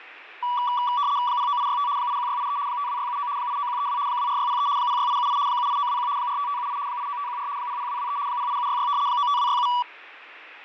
RTTY (75 baud, 170 Hz shift), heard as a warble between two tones, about 1060 Hz centre, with radio static and fading. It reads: 09865 81683 52679 89132 24603 06878 78921 45578 89514 00223 08766 95267